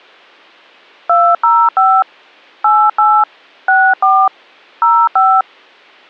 DTMF, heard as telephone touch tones, dialled by hand, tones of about 260 ms. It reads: 205 88 64 05